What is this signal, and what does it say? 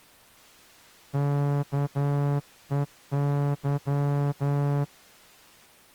Morse code, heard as a horn, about 11 wpm. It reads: KEY